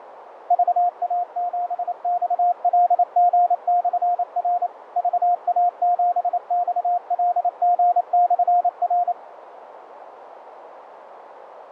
Morse code, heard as a keyed tone, machine-sent, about 28 wpm, 710 Hz, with radio static, fading and a narrow filter. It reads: VA7XLG/R VA7XLG/R